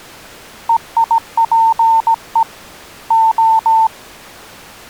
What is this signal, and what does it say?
Morse code (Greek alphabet), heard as a keyed tone, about 17 wpm, 900 Hz. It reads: ΕΙΠΕ Ο